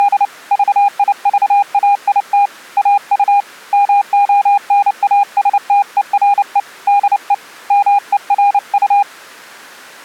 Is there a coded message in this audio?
Yes: Morse code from 0.0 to 9.1 s, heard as a keyed tone, hand-sent with a paddle, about 29 wpm, 810 Hz. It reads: … VIVAIT AU MONASTERE DE MERU